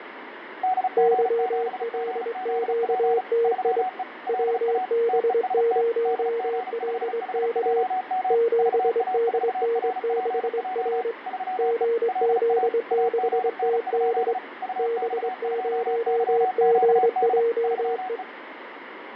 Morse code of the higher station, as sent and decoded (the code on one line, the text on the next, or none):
-.. --. --... --. --.. .--. / ...-- . / .-.. .- / - . ... - / -.. --. ..... .... .--- -- / ...- .- ....- .-. .--. .--- / ...-- . / .-.. .- / .- --. -. ..--.. / ..- -..- ..--- -.-- --.- -.. / ...-- .
DG7GZP 3E LA TEST DG5HJM VA4RPJ 3E LA AGN? UX2YQD 3E